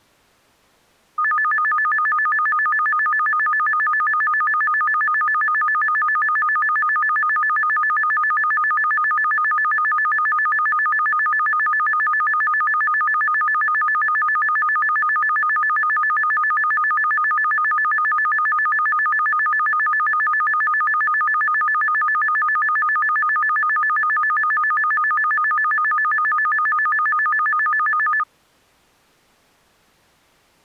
A tone that alternates evenly between two pitches. There is no code.